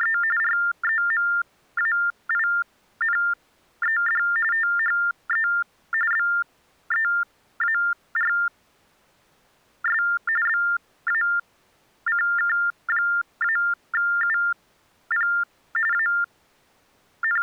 TTY/TDD text telephone tones (45.45 baud Baudot), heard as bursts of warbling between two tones, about 400 Hz shift, 1600 Hz centre. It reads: … REMAINED THE BEARS BACK-UP …